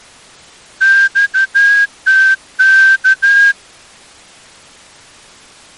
Morse code, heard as a whistle, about 13 wpm. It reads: XTK